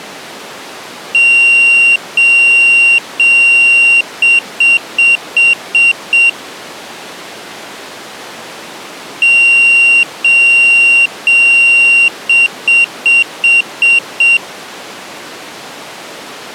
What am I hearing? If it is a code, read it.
Beep code, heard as a piezo beeper, played twice, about 2750 Hz. 3 long, 6 short.